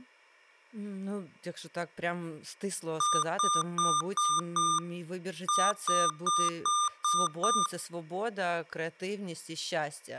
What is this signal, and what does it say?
Beep code, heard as beeps from a small speaker, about 1200 Hz, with speech in Ukrainian. 5-6.